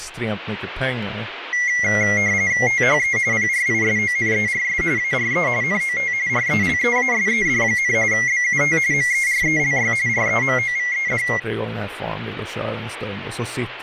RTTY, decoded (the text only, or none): THE PRISONERS ARE NOT RELEASED, BUT MERELY REMOVED